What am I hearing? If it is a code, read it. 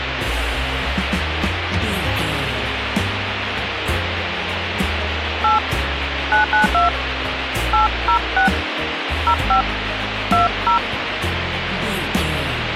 DTMF, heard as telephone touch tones, dialled by hand, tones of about 130 ms, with radio hiss. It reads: 8 992 806 05 20